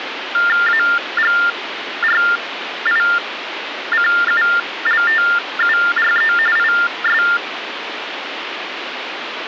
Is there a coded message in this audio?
Yes: TTY/TDD text telephone tones (45.45 baud Baudot) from 0.3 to 7.4 s, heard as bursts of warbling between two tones, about 400 Hz shift, 1600 Hz centre, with phone line noise. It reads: AGRICULTURE IS